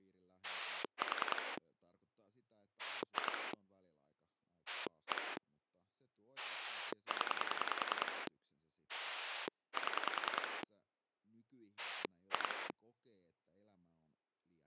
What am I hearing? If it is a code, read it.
Pulse dialling, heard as a rotary dial, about 10 pulses a second, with speech in Finnish. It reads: 4 2 1 0 7 2